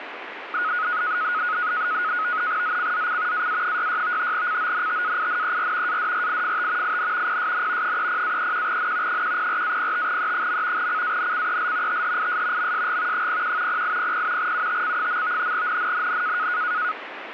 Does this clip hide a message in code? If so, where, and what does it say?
Yes: NAVTEX (SITOR-B), 100 baud, 170 Hz shift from 0.5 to 16.9 s, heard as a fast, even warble, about 1360 Hz centre, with radio static. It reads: ZCZC AA66 CONTAINER ADRIFT IN PSN 30-31N 104-05E. CANCEL THIS MSG 01 0800 UTC. NNNN